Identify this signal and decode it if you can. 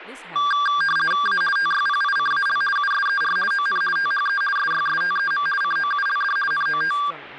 RTTY (50 baud, 450 Hz shift), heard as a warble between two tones, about 1380 Hz centre, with speech in English. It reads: A TYPICAL USER ON THE SYSTEM COULD NOT